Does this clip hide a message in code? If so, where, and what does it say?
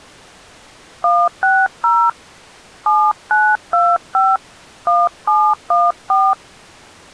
Yes: DTMF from 1.0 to 6.3 s, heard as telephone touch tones, dialled by hand, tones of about 250 ms. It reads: 160 7925 1714